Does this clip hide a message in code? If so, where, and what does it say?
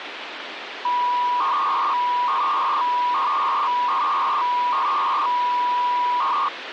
Yes: 300-baud modem data (V.21 tones) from 0.8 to 6.5 s, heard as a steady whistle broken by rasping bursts, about 300 baud, 200 Hz shift, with phone line noise.